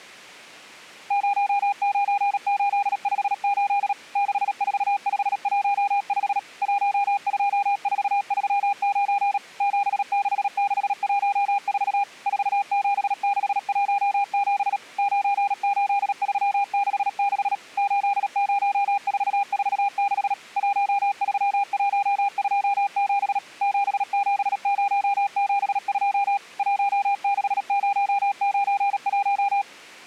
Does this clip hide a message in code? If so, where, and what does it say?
Yes: Morse code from 1.0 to 29.7 s, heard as a keyed tone, machine-sent, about 37 wpm, 800 Hz. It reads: 09858 64515 12439 76614 47617 98366 80446 13127 77072 16091